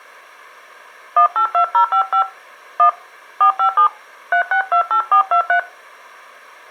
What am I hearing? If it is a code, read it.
DTMF, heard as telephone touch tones, dialled by hand, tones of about 100 ms. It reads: 182055 1 457 3628423